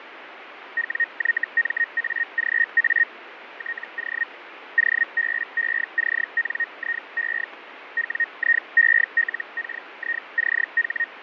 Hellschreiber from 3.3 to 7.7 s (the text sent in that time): TO OBECNIE